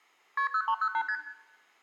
Multi-frequency trunk signalling (R1, as on North American trunks), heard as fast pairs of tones, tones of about 70 ms, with room echo. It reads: KP 0308 ST